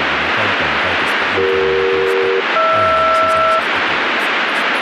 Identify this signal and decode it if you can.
Aircraft SELCAL, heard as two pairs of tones, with radio static. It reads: CE-HR